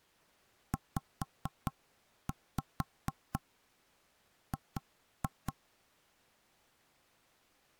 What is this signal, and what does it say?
Tap code, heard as knocks on wood, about 4 knocks a second. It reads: ZG